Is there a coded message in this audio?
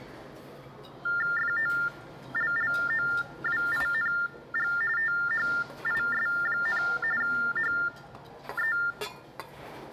Yes: TTY/TDD text telephone tones (45.45 baud Baudot) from 1.1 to 8.9 s, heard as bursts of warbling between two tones, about 400 Hz shift, 1600 Hz centre, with the noise of a restaurant. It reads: FOLLOWING THIS, HE